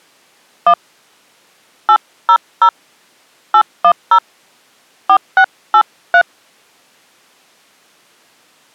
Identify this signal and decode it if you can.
DTMF, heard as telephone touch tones, dialled by hand, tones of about 70 ms. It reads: 1 800 810 4683